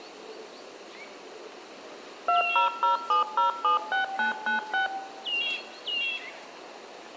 DTMF, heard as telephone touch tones, dialled by machine, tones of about 130 ms, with room echo. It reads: 2007076996